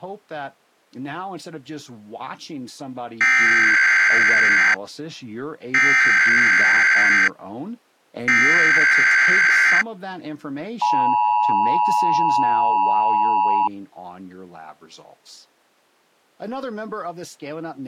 Emergency Alert System (SAME) tones (header bursts, then the 853 and 960 Hz attention tone), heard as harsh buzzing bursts, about 520.83 baud, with speech in English.